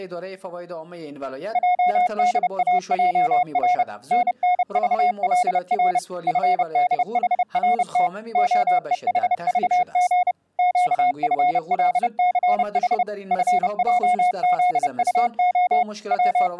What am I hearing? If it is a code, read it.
Morse code, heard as a keyed tone, machine-sent, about 30 wpm, 720 Hz. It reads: JDAJR NNVLR FDHRT OEHVG QFLCH FJZUO …